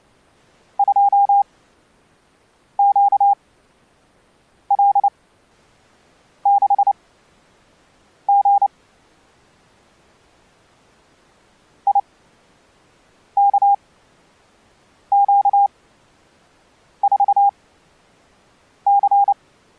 Morse code, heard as a keyed tone, machine-sent, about 29 wpm, spaced as for 6 wpm, 800 Hz. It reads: 2QL6G IKQ4C